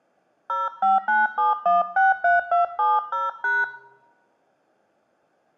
DTMF, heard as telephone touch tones, dialled by hand, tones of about 170 ms, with room echo. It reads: 0597163270#